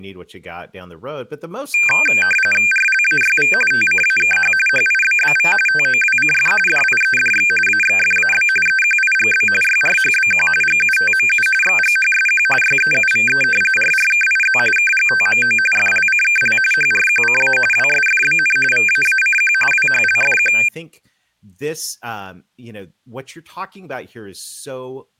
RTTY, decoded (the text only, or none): RLAYV TCAKH HIBBV TOWCF DIEDX AXFAB EQIGB YRHBQ GUTMU XGHSQ YEUVE RRKIZ KGTMO FLCKL HRQCA WSFBN VAACQ WHLFQ